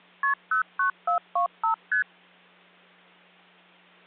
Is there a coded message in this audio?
Yes: multi-frequency trunk signalling (R1, as on North American trunks) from 0.2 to 2.0 s, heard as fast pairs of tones, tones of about 110 ms, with hum. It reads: KP 09425 ST